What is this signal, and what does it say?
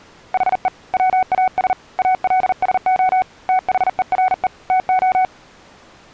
Morse code, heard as a keyed tone, hand-sent with a paddle, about 40 wpm, 750 Hz. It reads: HE WAS ALSO THERE TO